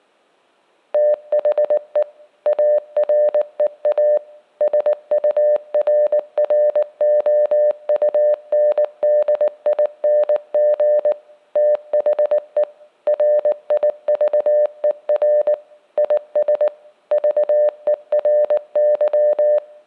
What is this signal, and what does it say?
Morse code, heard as a keyed tone, machine-sent, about 19 wpm, 600 Hz, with room echo. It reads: THE AREA SURROUNDING THE RIVER IS VERY